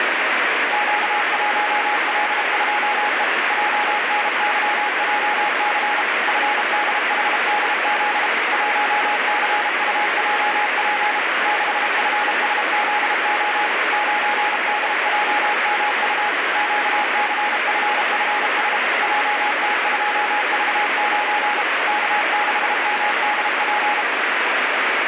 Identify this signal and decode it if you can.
Morse code, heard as a keyed tone, machine-sent, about 32 wpm, 840 Hz, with heavy radio static. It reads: Q1L2E JNYJC FDHDZ 1CUJP 6FSZO 9DJMU QCFFS JT2V9 K6MDP